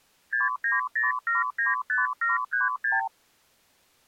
Multi-frequency trunk signalling (R2, with the far end's replies), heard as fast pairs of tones, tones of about 160 ms. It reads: 690795736